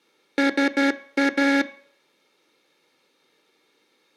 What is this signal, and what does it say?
Morse code, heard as a buzzer, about 12 wpm, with room echo. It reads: SA